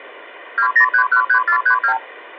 Multi-frequency trunk signalling (R2, with the far end's replies), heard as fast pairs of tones, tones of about 90 ms. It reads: 20313432